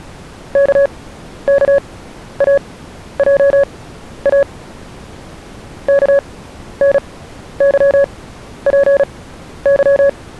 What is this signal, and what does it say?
Morse code, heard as a keyed tone, machine-sent, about 36 wpm, spaced as for 12 wpm, 560 Hz. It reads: KKAJA KNYPY